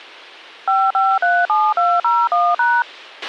DTMF, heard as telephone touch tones, dialled by machine, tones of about 230 ms, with a squelch burst at the end. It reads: 5537201#